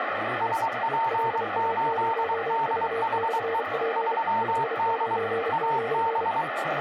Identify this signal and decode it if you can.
Morse code, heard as two keyed tones, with radio static and speech in Urdu. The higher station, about 23 wpm, 910 Hz: SP8DHE 3D AB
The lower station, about 32 wpm, 460 Hz: LA0V/P 599